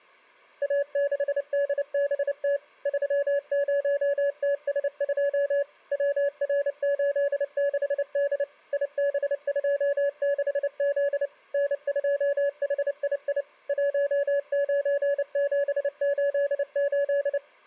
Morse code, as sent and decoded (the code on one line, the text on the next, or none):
.- -.... -.. -... - / ...-- ----- - ... ..--- / .-- .-. ---.. -.... -.. / .. -... ..--- -.... --.. / -. ..--- .... .. .. / .---- ----. --... ---.. ---..
A6DBT 30TS2 WR86D IB26Z N2HII 19788